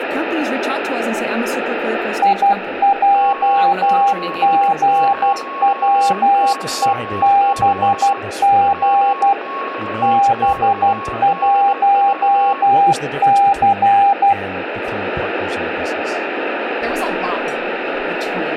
Morse code, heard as two keyed tones, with radio static and speech in English. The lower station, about 12 wpm, 800 Hz: IJGWEBG B1C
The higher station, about 18 wpm, 1100 Hz: M70YZ WXXDV